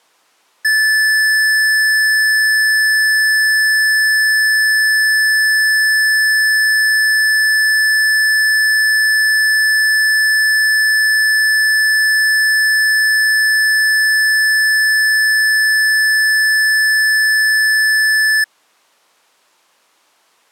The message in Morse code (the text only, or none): none